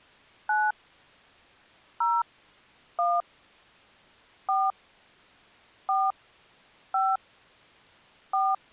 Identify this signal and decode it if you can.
DTMF, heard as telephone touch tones, dialled by hand, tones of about 220 ms. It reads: 9 0 1 4 4 5 4